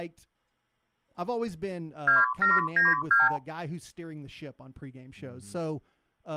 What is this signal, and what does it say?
Multi-frequency trunk signalling (R2, with the far end's replies), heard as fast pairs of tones, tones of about 170 ms, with speech in English. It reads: 2792